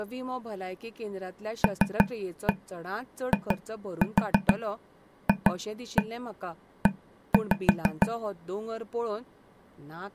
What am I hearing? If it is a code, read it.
Tap code, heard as taps on a table, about 6 knocks a second, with speech in Goan Konkani. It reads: LIFE